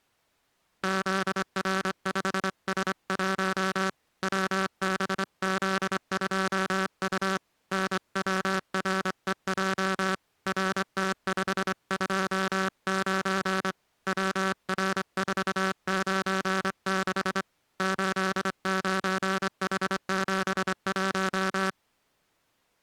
Morse code, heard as a buzzer, hand-sent with a straight key, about 25 wpm. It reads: ZR5S1 WBZ2U NWREJ RT529 WR496 89H71